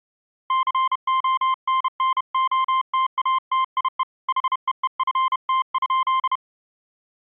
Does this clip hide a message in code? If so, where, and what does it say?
Yes: Morse code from 0.4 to 6.4 s, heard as a keyed tone, hand-sent with a paddle, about 31 wpm, 1050 Hz. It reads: CONNOTATIE HEEFT?